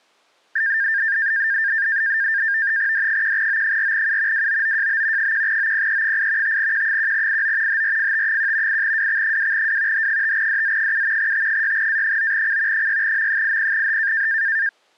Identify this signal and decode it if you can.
NAVTEX (SITOR-B), 100 baud, 170 Hz shift, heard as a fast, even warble, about 1700 Hz centre. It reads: D1O4U WOOJB 1OPE8 5Q1IO HRFT1 8WX2W H5DZ7 T6A9C 6M80H